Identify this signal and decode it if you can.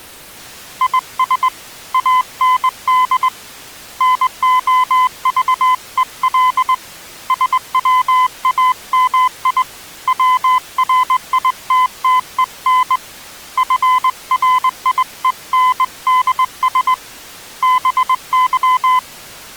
Morse code, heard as a keyed tone, hand-sent with a straight key, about 20 wpm, 1020 Hz. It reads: IS AND NOVEL SWAMI WRITTEN FRIENDS BY